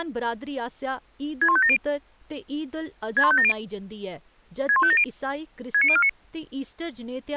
Five-tone selective call (ZVEI), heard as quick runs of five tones, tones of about 70 ms, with speech in Dogri. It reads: 61570 61570 61570 69049